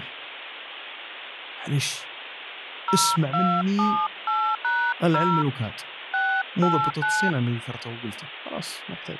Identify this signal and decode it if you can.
DTMF, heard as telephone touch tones, dialled by hand, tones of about 280 ms, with phone line noise and speech in Arabic. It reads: 0278#0 689